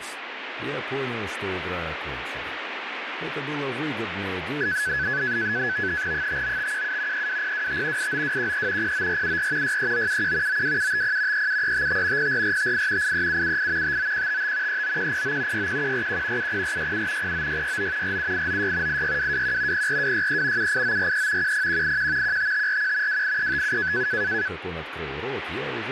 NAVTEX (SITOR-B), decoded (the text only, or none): 59517 32025 89213 09474 63971 92750 37355 04458 83778 59155 39109 61141 70467 09669 47896 86221 04263 78943 10181 15541 28357